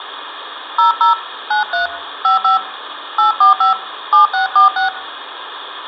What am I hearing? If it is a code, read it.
DTMF, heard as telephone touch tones, dialled by hand, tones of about 130 ms, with phone line noise. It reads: 00 93 55 845 7646